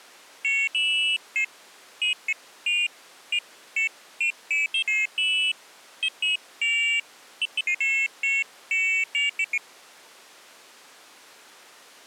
Pairs of high tones at irregular times. There is no code.